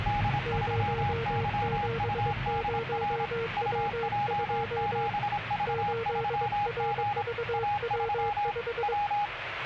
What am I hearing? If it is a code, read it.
Morse code, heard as two keyed tones, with radio static and the noise inside a car. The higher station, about 26 wpm, 820 Hz: D3YUDR UJ7V3G A3 W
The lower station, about 22 wpm, 460 Hz: 070W2 8RVW5